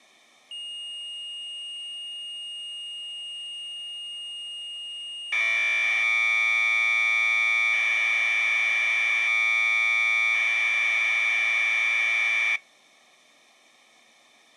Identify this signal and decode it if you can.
Commodore tape loading (standard loader), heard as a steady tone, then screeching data.